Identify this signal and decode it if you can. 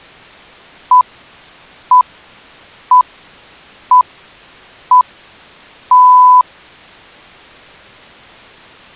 Radio time signal (six pips, as the Greenwich Time Signal), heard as pips.